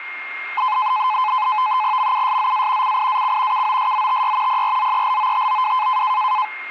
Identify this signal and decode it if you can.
NAVTEX (SITOR-B), 100 baud, 170 Hz shift, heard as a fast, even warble, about 940 Hz centre, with a steady whistle near 2130 Hz. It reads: MUSZA CIAC KOSZTY PRZELOTOW